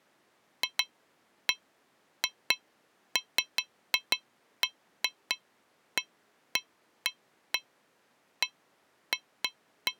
Irregular taps on a metal pipe. There is no code.